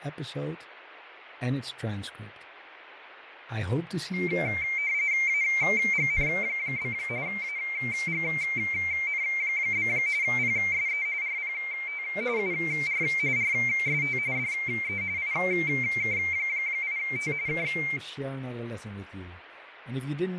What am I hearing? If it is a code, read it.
RTTY (45.45 baud, 170 Hz shift), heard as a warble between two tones, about 2200 Hz centre, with radio static, fading and speech in English. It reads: AGN? AGN? PSE RPT UR RST DE IK8T K